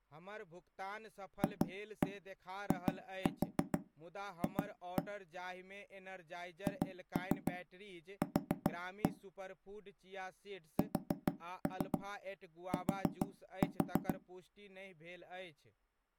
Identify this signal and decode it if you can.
Tap code, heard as knocks on wood, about 6 knocks a second, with speech in Maithili. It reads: FIF HQ ST